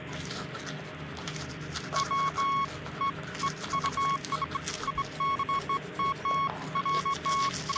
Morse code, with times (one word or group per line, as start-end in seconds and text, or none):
none